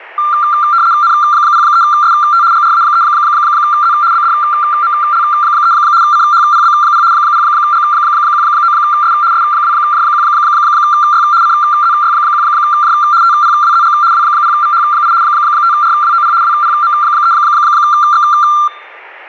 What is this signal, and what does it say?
RTTY (75 baud, 170 Hz shift), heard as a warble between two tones, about 1280 Hz centre. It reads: N03ST GRA3Z BDML3 CHPB0 0G19S S2J1Y CZY1J TPWZG W0VH8 5RWOP WPM3X